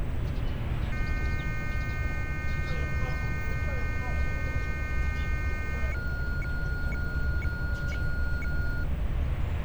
Weather fax (radiofax), 120 lines a minute, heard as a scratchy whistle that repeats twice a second, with radio static and street noise.